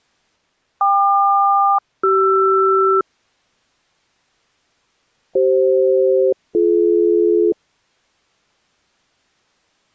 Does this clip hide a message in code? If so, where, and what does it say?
Yes: aircraft SELCAL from 0.8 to 7.5 s, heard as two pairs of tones. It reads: KQ-CR CF-BD